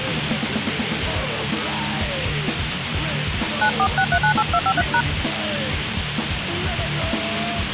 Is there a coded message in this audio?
Yes: DTMF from 3.6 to 5.0 s, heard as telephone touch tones, dialled by hand, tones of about 70 ms, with phone line noise. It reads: 946398253#